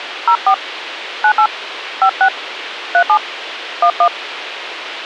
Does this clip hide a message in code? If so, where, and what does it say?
Yes: DTMF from 0.3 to 4.1 s, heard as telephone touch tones, dialled by hand, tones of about 80 ms, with radio hiss. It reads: 04 98 56 37 11